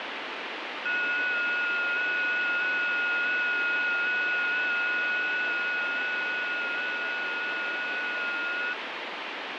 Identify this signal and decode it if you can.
FT8 (several signals at once), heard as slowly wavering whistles, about 6.25 baud, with heavy radio static.